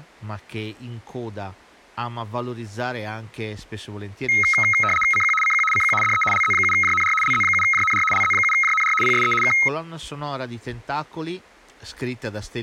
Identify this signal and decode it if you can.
RTTY (75 baud, 850 Hz shift), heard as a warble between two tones, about 1700 Hz centre, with speech in Italian. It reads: CQ CQ CQ DE LZ7JNR LZ7JNR LZ7JNR PSE K